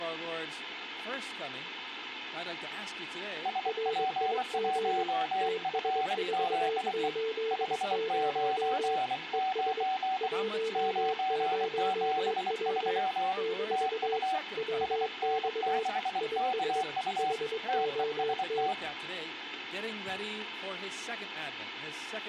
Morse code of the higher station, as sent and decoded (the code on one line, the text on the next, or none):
... .--. .---- ..-. --.. . / ..... ----. ----. / ----. --... ...-- / - ..- / ... -. -.... -.- ..- / - . ... -
SP1FZE 599 973 TU SN6KU TEST